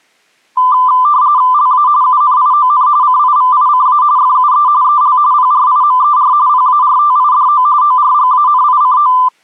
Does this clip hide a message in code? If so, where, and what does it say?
Yes: RTTY (45.45 baud, 170 Hz shift) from 0.6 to 9.3 s, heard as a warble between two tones, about 1100 Hz centre. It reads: LA UNION CIVICA FUE EL PRIMER PARTIDO ORGANICO